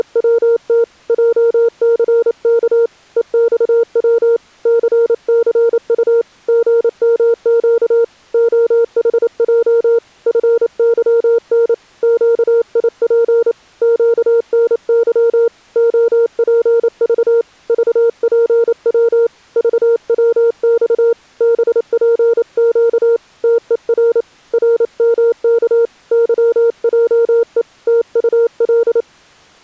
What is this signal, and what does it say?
Morse code, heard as a keyed tone, hand-sent with a paddle, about 28 wpm, 460 Hz. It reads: … JCK EXW CCU GMQ OHJ FYN QIP QNY OPV VPW VWX BPQ TER RMK YJE TUL